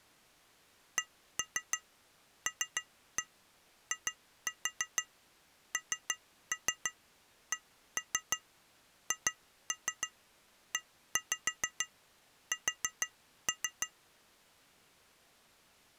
Tap code, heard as taps on glass, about 6 knocks a second. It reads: CLINCHES